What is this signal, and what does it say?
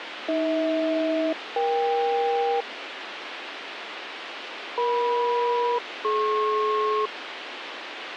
Aircraft SELCAL, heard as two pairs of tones, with radio hiss. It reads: AH-EK EM-DP